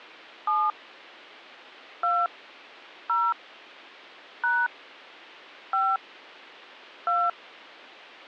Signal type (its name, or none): DTMF